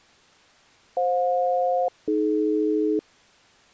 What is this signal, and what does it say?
Aircraft SELCAL, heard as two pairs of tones. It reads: FJ-AD